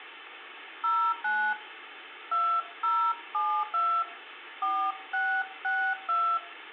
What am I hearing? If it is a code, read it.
DTMF, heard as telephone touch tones, dialled by hand, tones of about 290 ms, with phone line noise and room echo. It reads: 09 2072 4662